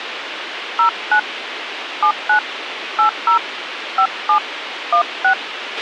DTMF, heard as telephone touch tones, dialled by hand, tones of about 90 ms, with radio hiss and a squelch burst at the end. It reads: 09 79 80 57 16